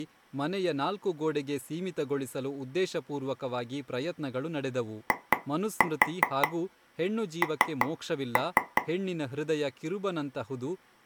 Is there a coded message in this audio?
Yes: tap code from 5.1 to 8.8 s, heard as taps on a table, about 5 knocks a second, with speech in Kannada. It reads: IN